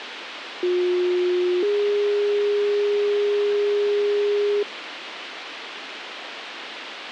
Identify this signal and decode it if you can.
Two-tone page, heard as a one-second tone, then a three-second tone, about 360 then 410 Hz, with radio hiss.